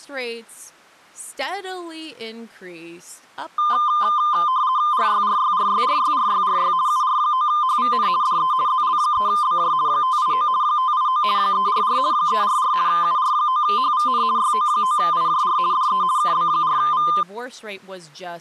RTTY (50 baud, 170 Hz shift), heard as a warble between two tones, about 1120 Hz centre, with speech in English. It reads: RYRYRYRYRYRY UR9HVN DE ZL3BJ 589 589 344 344 UR9HVN YO9IJR DE KB4V